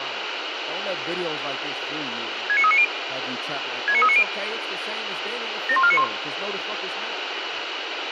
Five-tone selective call (ZVEI), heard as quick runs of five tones, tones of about 70 ms, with radio hiss and speech in English. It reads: 69390 69390 71491